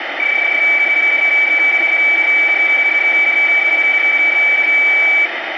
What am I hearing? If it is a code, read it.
PSK31 (31.25 baud), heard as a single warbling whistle, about 2300 Hz, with radio static.